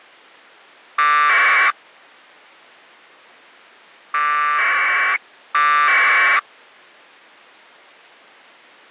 Packet radio (AX.25, as in APRS), 1200 baud, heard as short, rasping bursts.